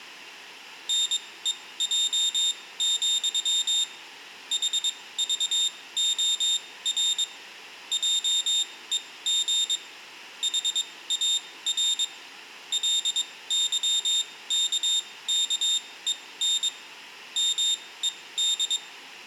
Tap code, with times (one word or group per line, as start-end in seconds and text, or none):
none